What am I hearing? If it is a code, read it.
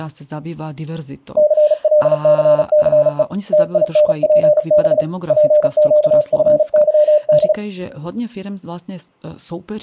Morse code, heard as a keyed tone, hand-sent with a paddle, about 36 wpm, 590 Hz, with speech in Slovak. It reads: CLCCE TINPB PQFYD